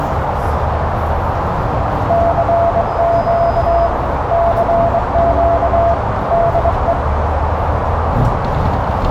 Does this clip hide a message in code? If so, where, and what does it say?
Yes: Morse code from 2.0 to 7.0 s, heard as a keyed tone, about 22 wpm, 680 Hz, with heavy radio static, a narrow filter and the noise inside a bus. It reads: CQ CQ DE